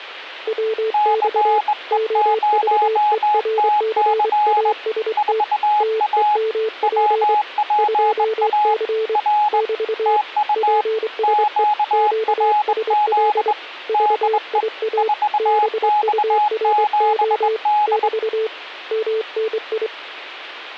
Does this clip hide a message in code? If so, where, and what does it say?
Yes: Morse code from 0.4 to 19.9 s, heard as two keyed tones. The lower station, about 24 wpm, 440 Hz: WX OVERCAST TEMP 2C <BT> PSE QSL VIA BURO <BT> MNI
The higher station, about 21 wpm, 840 Hz: CE0TC 4A WPA R TU QRZ DE 4X7D